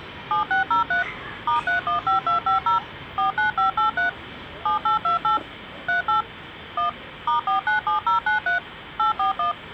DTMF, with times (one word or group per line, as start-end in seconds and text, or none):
0.3-1.0 7603
1.5-2.8 *315250
3.2-4.1 49583
4.7-5.4 7828
5.9-6.2 38
6.8-6.9 1
7.3-8.6 *497093
9.0-9.5 841